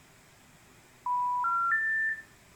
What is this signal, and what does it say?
Telephone call progress tone (North American plan), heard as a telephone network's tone, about 980, 1370, 1800 Hz, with room echo. Special information tone.